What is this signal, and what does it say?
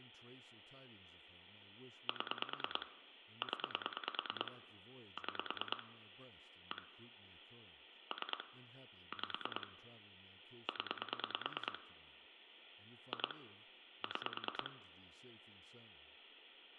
Pulse dialling, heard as clicks on a phone line, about 9 pulses a second, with phone line noise, room echo and speech in English. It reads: 7 0 6 1 3 5 0 2 6